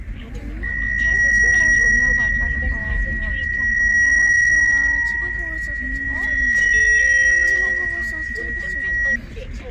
PSK63 (62.5 baud), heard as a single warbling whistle, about 1900 Hz, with radio static, fading and the noise inside a car.